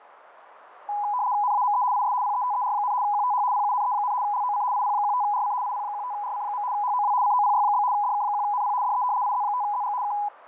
RTTY (75 baud, 170 Hz shift), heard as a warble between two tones, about 910 Hz centre, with radio static. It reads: NAME IS PETER, QTH PUNE, LOC IP15RC IP15RC. HOW COPY? DK1NP DE IZ5ZG K